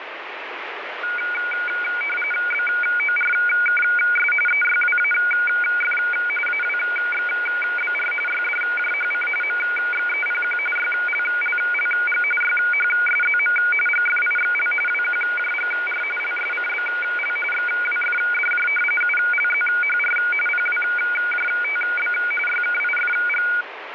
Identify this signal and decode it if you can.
RTTY (45.45 baud, 850 Hz shift), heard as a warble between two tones, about 1850 Hz centre, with radio static. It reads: BORKS EYWAF AWXBR YDJHC MXEPQ YLLLG YHSZM GFIXL WQJGR LSCBL XWFDJ ULZHR PWJTB YKIFG